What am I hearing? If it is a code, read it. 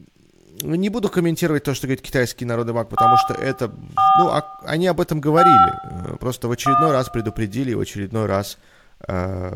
DTMF, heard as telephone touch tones, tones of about 240 ms, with room echo and speech in Russian. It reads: 4 4 5 1